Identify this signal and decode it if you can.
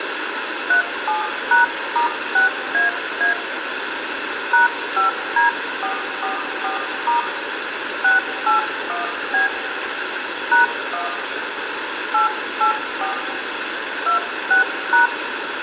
DTMF, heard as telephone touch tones, dialled by hand, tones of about 130 ms, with radio hiss and room echo. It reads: 37#*6AA #5D444* 681B #1 884 26#